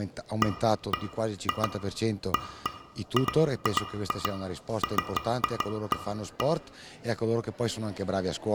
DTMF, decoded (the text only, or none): none